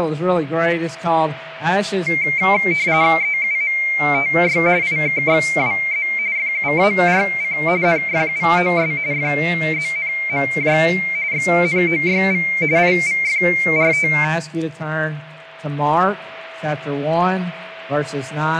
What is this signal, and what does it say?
RTTY (45.45 baud, 170 Hz shift), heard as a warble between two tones, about 2200 Hz centre, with a steady whistle near 650 Hz. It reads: EUMTY IKXWZ FUARC NFUOS FZNMJ XNOYV IVFRT